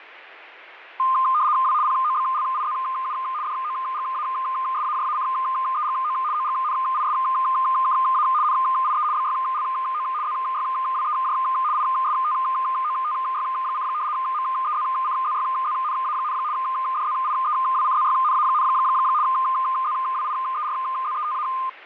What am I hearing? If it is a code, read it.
RTTY (75 baud, 170 Hz shift), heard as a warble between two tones, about 1130 Hz centre. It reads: W POBLIZU DOGASAJACEGO OGNISKA NIE BYLO ZYWEJ ISTOTY: MEZCZYZNA, DZIEWCZYNA, ZWIERZETA